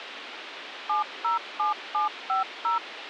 DTMF, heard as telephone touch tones, dialled by machine, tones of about 130 ms, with radio hiss. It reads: 707750